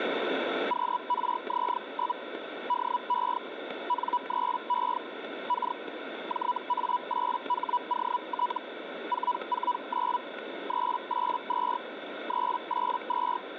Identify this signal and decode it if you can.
Hellschreiber (Feld-Hell, 122.5 baud), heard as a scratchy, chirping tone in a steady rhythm, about 980 Hz, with radio static. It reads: QRZ? DE N3E K JA8HOT 449 382 382